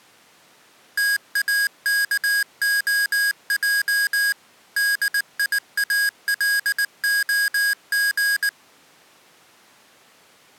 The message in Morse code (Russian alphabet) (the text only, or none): ТАКОЙ ДИАЛОГ